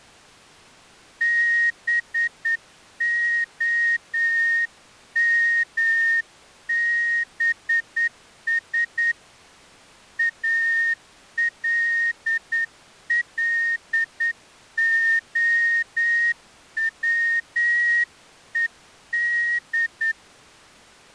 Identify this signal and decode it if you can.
Morse code, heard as a whistle, hand-sent with a straight key, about 9 wpm. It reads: BOMBS ALLOWED